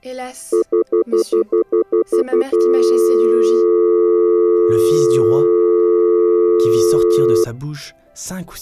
Telephone call progress tone (North American plan), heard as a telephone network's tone, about 350, 440 Hz, 0.1 s on and 0.1 s off. Stutter dial tone.